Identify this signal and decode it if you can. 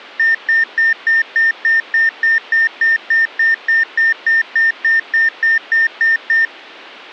Evenly repeated beeps. There is no code.